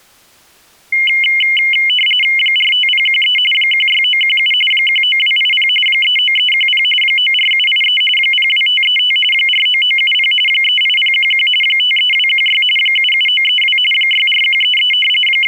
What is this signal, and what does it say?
RTTY (45.45 baud, 850 Hz shift), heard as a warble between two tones, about 2550 Hz centre. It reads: 45013 16917 19280 39310 94783 02535 49970 38011 53216 77932 64133 …